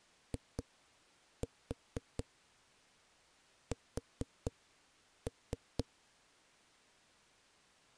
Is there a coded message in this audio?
Yes: tap code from 0.3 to 5.8 s, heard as knocks on a wall, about 4 knocks a second. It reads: IS